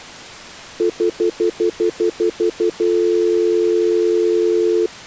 Telephone call progress tone (North American plan), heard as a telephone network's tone, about 350, 440 Hz, 0.1 s on and 0.1 s off. Stutter dial tone.